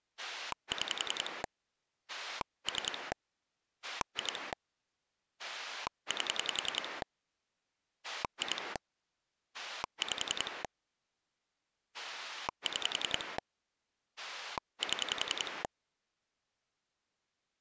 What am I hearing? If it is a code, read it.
Pulse dialling, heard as a rotary dial, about 10 pulses a second. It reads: 6 3 2 8 2 5 6 7